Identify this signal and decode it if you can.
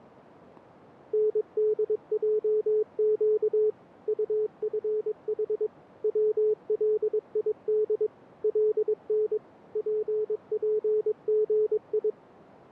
Morse code, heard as a keyed tone, machine-sent, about 22 wpm, 430 Hz. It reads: NDJQ UFH WLID LN PPGI